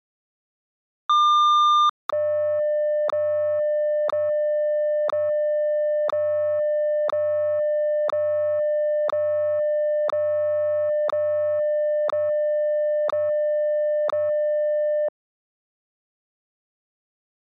Radio time signal (WWVH, Hawaii), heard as ticks, one a second.